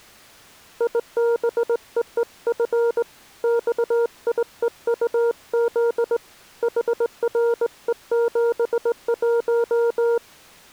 Morse code, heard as a keyed tone, hand-sent with a straight key, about 19 wpm, 470 Hz. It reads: IBEEF XIEUZ HRE71